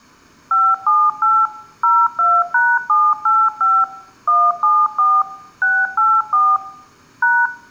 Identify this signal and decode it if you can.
DTMF, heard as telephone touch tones, dialled by machine, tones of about 240 ms, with room echo. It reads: 578 02#785 174 684 #